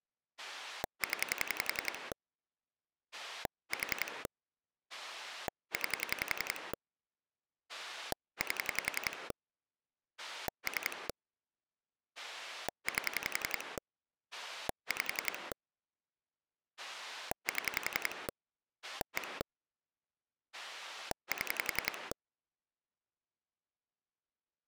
Pulse dialling, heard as a rotary dial, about 11 pulses a second. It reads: 0 4 9 8 3 8 5 7 1 7